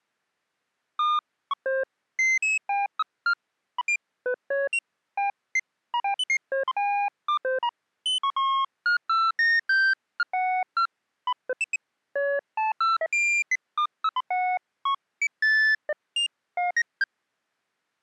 Electronic bleeps of random pitch and length. There is no code.